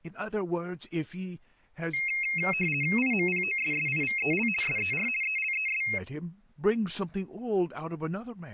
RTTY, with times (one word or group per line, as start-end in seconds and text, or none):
3.0-4.5 IMPOSSIVEL
4.6-5.1 SER
5.2-5.8 ELES